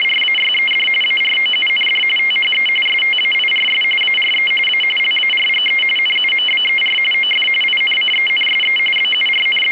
RTTY (45.45 baud, 850 Hz shift), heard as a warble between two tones, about 2550 Hz centre. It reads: … AROUND THE STAIRS ARE A LARGE NUMBER OF INCENSE …